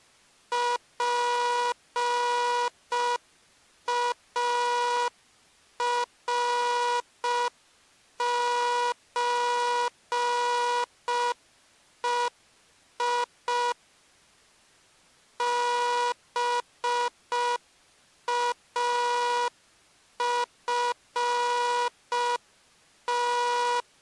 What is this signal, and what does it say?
Morse code (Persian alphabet), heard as a buzzer, machine-sent, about 5 wpm. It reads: پارچهی بافت